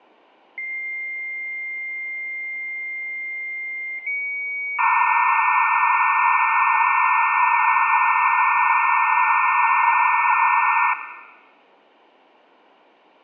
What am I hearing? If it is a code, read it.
Dial-up modem handshake (low-speed, two carriers), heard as two whistles, then hiss, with room echo.